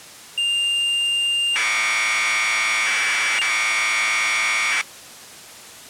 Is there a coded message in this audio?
Yes: Commodore tape loading (standard loader) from 0.4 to 4.8 s, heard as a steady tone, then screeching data.